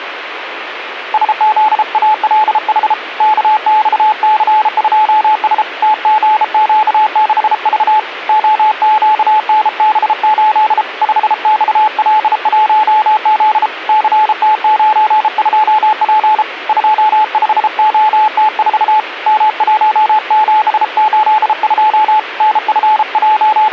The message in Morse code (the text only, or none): SZALH KXC2S TGQ6V OQNB8 5XL1Z CT92P 25OT4 M1782 …